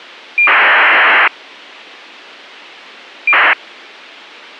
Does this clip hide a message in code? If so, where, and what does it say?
Yes: ACARS aircraft data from 0.4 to 3.5 s, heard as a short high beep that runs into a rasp, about 2400 baud, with a squelch burst at the end.